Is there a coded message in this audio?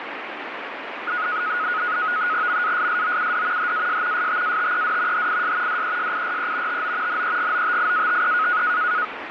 Yes: NAVTEX (SITOR-B), 100 baud, 170 Hz shift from 1.1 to 9.0 s, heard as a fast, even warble, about 1360 Hz centre, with radio static. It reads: MASSOUD HAS STATED HIS DESIRE TO NEGOTIATE